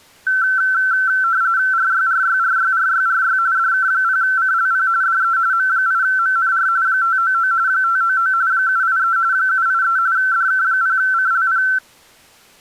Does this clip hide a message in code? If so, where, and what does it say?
Yes: RTTY (45.45 baud, 170 Hz shift) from 0.3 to 11.8 s, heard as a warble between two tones, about 1440 Hz centre. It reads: RYRYRYRYRY DK0CLP DE M8MNR 599 599 783 783 DK0CLP